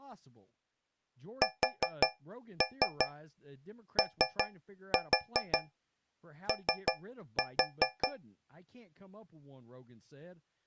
Tap code, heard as taps on a metal pipe, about 5 knocks a second, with speech in English. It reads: SOO